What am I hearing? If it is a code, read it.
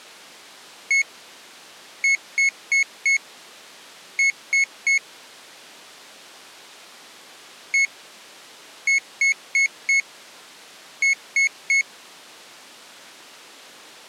Beep code, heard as a piezo beeper, played twice, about 2200 Hz. 1-4-3.